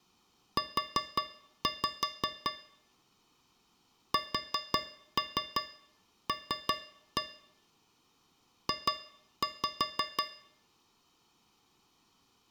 Tap code, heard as taps on a metal pipe, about 5 knocks a second. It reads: U SL J